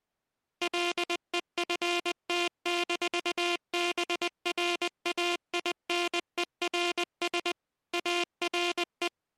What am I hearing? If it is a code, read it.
Morse code, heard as a buzzer, machine-sent, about 20 wpm. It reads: LEFT-BRAINERS ARE